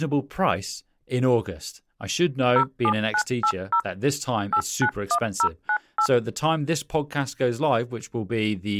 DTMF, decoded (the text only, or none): 07980 891098